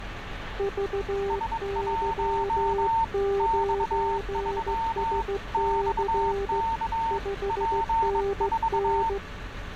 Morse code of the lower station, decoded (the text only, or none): VY9SC 5NN